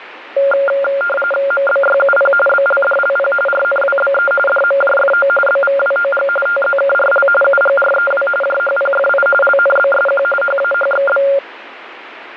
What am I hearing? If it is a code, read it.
RTTY (45.45 baud, 850 Hz shift), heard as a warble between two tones, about 980 Hz centre, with radio static. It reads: MBYUP BLDLP RNWBE DMJFO BVWOG TZKRL UGREW JHPFI LNBSQ HAHXB